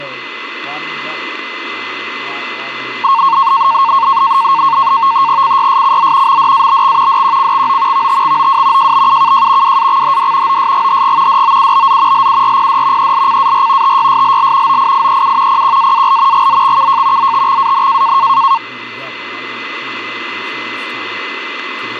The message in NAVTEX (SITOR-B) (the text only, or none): CYSCZ MDABX DQCXO VTXOW JBUKJ WAXHD OSGHG DOUBZ LURPD ELCAR TYSLL OIIEU PQAAL GZXKJ ZTXAN